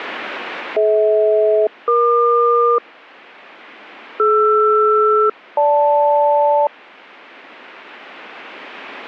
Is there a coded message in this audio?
Yes: aircraft SELCAL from 0.8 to 6.7 s, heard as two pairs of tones. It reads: DH-EQ DR-GL